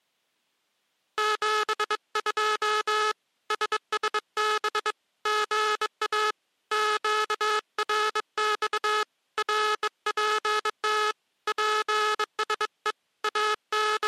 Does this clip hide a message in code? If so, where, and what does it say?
Yes: Morse code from 1.1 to 14.1 s, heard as a buzzer, hand-sent with a bug key, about 22 wpm. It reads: 72 SSB GA QRX RPT PSE …